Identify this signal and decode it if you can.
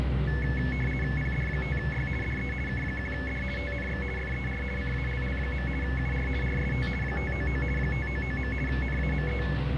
RTTY (50 baud, 450 Hz shift), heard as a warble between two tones, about 1950 Hz centre, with radio static and the noise inside a lift. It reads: PD5Y DE K1D TNX FER CALL. UR RST 599 599. NAME